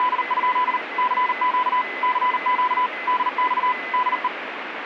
Morse code, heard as a keyed tone, machine-sent, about 39 wpm, 1000 Hz, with radio static and a weaker station near 2020 Hz. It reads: … CQ CQ DX DE